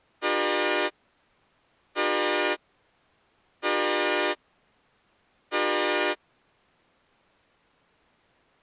Train horn signal, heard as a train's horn. 4 short. On North American railways: a request for a signal to be given or repeated.